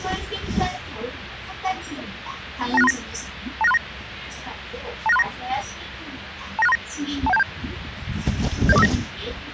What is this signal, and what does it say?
Five-tone selective call (EIA), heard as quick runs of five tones, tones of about 30 ms, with radio hiss and the noise inside a bus. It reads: 29639 29639 29639 29639 21727 70459